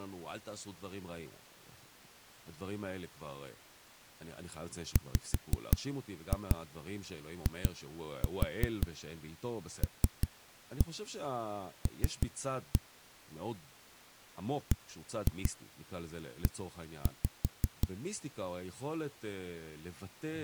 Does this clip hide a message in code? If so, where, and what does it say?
Yes: tap code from 5.0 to 17.9 s, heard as knocks on a wall, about 5 knocks a second, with speech in Hebrew. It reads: WILL BE